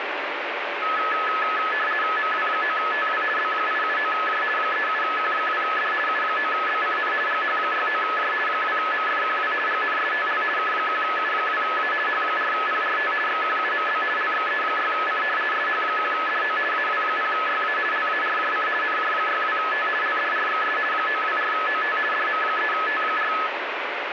RTTY (50 baud, 450 Hz shift), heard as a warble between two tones, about 1500 Hz centre, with radio static. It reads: MW9TW B879J 37Q2D U9BCN GH69J 2MFQW GNSTL K1U2A H4PRT XQUMB LXE6C SH1DO AW0YA LARJC NJ62T LDRXS 924OT DM3T4